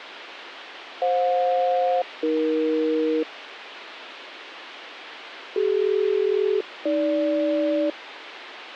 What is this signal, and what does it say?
Aircraft SELCAL, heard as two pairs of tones, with radio hiss. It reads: FJ-AE CD-AG